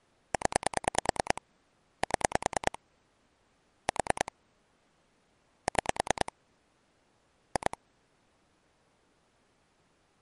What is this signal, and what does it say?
Pulse dialling, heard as clicks on a phone line, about 9 pulses a second. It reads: 0 7 4 6 2